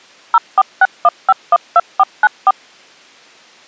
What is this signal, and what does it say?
DTMF, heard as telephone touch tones, dialled by machine, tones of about 40 ms. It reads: 0461512494